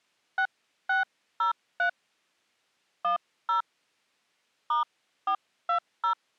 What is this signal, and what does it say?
DTMF, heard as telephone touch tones, dialled by hand, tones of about 110 ms. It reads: 6603 10 *420